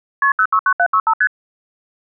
Multi-frequency trunk signalling (R1, as on North American trunks), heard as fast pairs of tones, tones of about 70 ms. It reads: KP 069765 ST